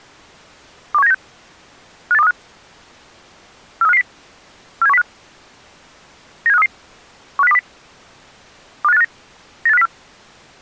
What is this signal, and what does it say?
Five-tone selective call (EEA), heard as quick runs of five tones, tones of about 40 ms. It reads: 21796 58235 43550 47105 97533 15020 25859 98504